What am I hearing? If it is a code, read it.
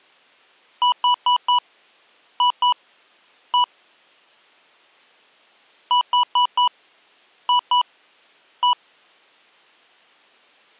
Beep code, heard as beeps from a small speaker, played twice, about 980 Hz. 4-2-1. In Phoenix BIOS tables: timer tick failure.